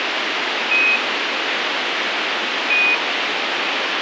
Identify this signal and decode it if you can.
Quindar tones, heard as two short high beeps, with radio hiss.